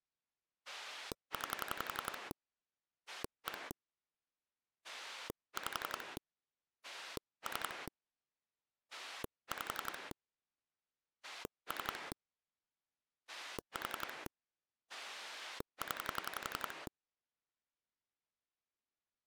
Pulse dialling, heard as a rotary dial, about 11 pulses a second. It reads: 9 1 5 3 5 3 4 0